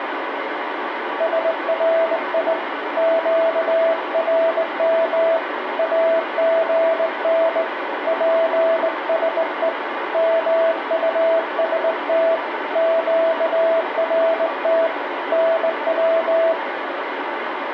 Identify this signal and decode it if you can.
Morse code, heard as a keyed tone, hand-sent with a straight key, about 19 wpm, 660 Hz, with radio static. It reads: SRI QRM AGN PSE MUST QRT NW